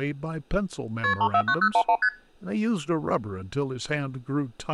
Multi-frequency trunk signalling (R1, as on North American trunks), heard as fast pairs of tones, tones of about 70 ms, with speech in English. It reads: KP 349011 ST